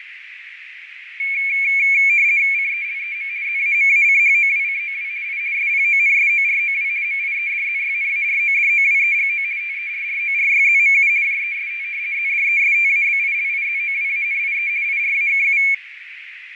RTTY (50 baud, 170 Hz shift), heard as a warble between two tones, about 2300 Hz centre, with radio static, fading and a narrow filter. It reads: CELEM ZAMACHOWCOW I SPONSOROW MIEDZYNARODOWEGO TERRORYZMU JEST ZDESTABILIZOWANIE IRAKU